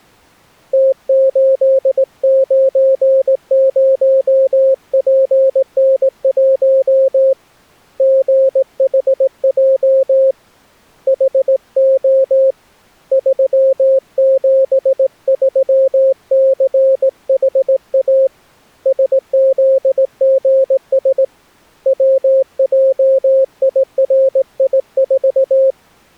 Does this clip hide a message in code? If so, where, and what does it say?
Yes: Morse code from 0.7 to 25.8 s, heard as a keyed tone, hand-sent with a straight key, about 18 wpm, 530 Hz. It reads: T890PN1 GHJ HO 373CHA SZGS WJIRI4